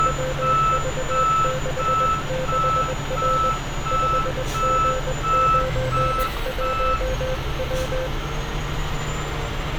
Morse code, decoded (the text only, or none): WV66R 5G91W